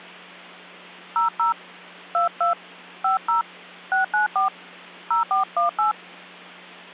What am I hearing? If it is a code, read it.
DTMF, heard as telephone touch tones, dialled by hand, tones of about 130 ms, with hum. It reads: 00 22 50 694 0418